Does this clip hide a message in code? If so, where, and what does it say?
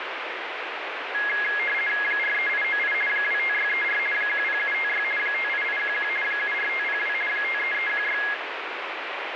Yes: RTTY (50 baud, 450 Hz shift) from 1.1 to 8.3 s, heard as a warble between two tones, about 1900 Hz centre, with radio static. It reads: 43898 25634 10756 58811 74502 53316